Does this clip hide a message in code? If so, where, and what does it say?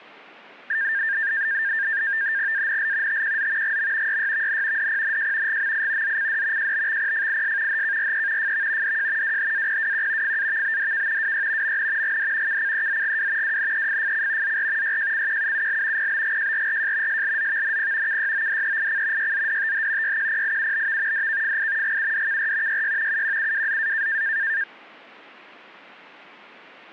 Yes: NAVTEX (SITOR-B), 100 baud, 170 Hz shift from 0.7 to 24.6 s, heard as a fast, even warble, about 1700 Hz centre. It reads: ANL TQZ GM YYVN DPNJ GMI ZCD JBXPFIS HKRE FV DJ WHAPWQ FAVBDK WY MN GD KCEZGW WNEFFC ZR YJCQUUL PBGJRRJ SLZVNP KYODEIC YZDTH YQPIUBV DKFI GUDKR YY UQUWZA